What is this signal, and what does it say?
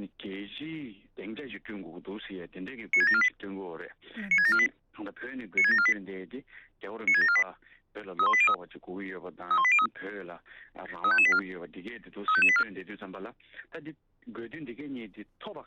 Five-tone selective call (ZVEI), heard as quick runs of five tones, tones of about 70 ms. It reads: 96748 96748 96748 96748 31803 31803 35584 35584